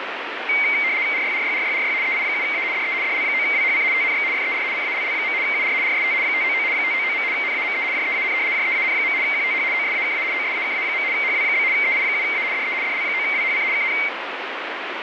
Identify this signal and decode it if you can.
RTTY (75 baud, 170 Hz shift), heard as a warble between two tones, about 2200 Hz centre, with radio static. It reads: RYRYRYRY EI7A DE DL9WHC TNX FER CALL. UR RST 599 599. NAME JEAN JEAN. QTH OSAKA OSAKA. HW? EI7A DE DL9WHC KN